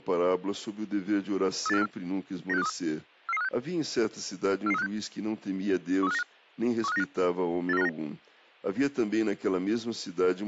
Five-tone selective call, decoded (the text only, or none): 38454 96523 44356 44356 13595 13595 84959